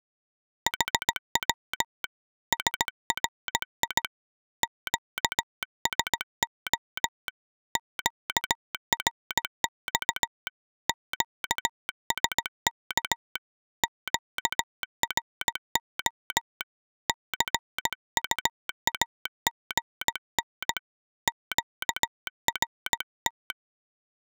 Morse code, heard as a telegraph sounder, hand-sent with a paddle, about 17 wpm. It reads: HW SRI QSO QRX QSK QRO CUAGN QRT